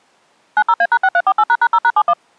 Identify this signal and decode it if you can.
DTMF, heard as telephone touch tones, dialled by machine, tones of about 60 ms. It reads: 90A#6348##0#71